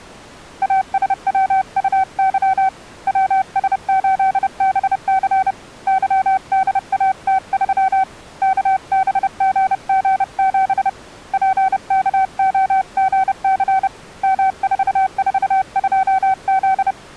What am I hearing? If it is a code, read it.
Morse code, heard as a keyed tone, hand-sent with a paddle, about 30 wpm, 760 Hz. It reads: ASWUY WS8BC YDAT3 KBGG7 PKOGC M442Z